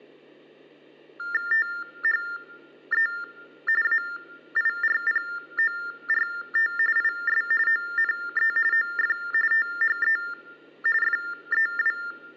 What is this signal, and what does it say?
TTY/TDD text telephone tones (45.45 baud Baudot), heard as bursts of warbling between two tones, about 400 Hz shift, 1600 Hz centre. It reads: THE AIRPORT IS ONE OF THE FEW